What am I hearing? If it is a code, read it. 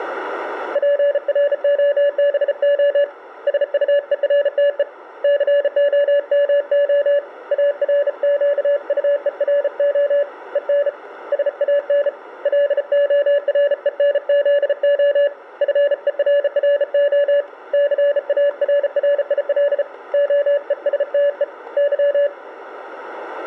Morse code, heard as a keyed tone, hand-sent with a bug key, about 34 wpm, 570 Hz. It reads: PROBO SUERTE COMO ARQUERO EN SAN LORENZO FERRO CARRIL OESTE Y